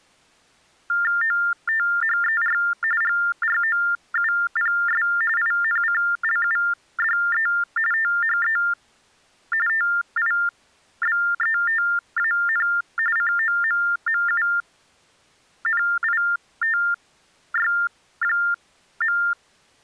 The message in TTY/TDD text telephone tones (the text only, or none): OTHER GROUPS INCLUDE THE TIBETAN COMMUNITY.